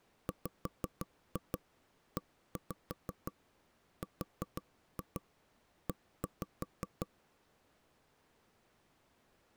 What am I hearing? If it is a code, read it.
Tap code, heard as knocks on wood, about 6 knocks a second. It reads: WERE